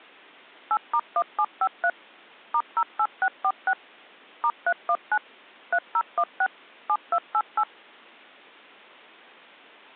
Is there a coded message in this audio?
Yes: DTMF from 0.7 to 7.6 s, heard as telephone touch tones, dialled by machine, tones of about 60 ms. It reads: 8*1753 *08646 *319 3016 7288